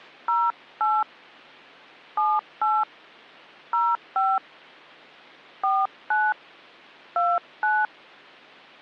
DTMF, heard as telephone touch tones, dialled by hand, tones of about 220 ms. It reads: 08 78 05 49 29